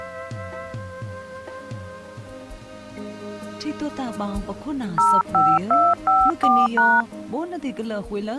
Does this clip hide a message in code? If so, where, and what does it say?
Yes: DTMF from 5.0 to 7.0 s, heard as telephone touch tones, dialled by hand, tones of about 230 ms. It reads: 05254#